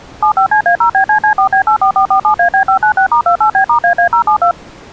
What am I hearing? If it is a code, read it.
DTMF, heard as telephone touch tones, dialled by machine, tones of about 100 ms. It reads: 75CA0BCC4B84447AB596*28B*AA072